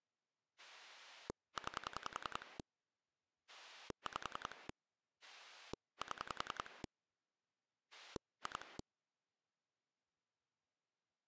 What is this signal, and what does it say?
Pulse dialling, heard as a rotary dial, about 10 pulses a second. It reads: 9 5 7 2